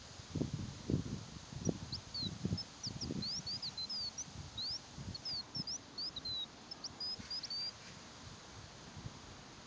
Bird-like chirps, with the noise of a park. There is no code.